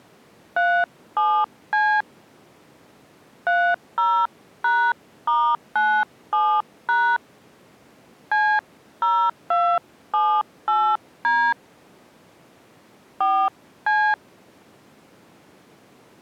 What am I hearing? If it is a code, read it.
DTMF, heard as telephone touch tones, dialled by hand, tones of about 280 ms. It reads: 37C 30#*97# C0278D 4C